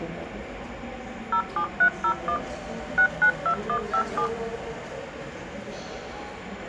DTMF, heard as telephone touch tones, dialled by machine, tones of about 80 ms, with the noise of a subway station. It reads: 07301 692157